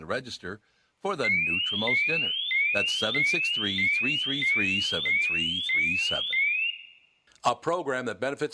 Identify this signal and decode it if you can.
A tone that sweeps in pitch again and again, with room echo and speech in English. There is no code.